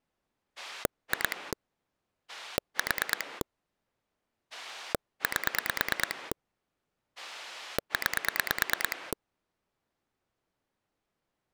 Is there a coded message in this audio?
Yes: pulse dialling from 0.6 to 9.1 s, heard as a rotary dial, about 9 pulses a second. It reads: 2 4 8 9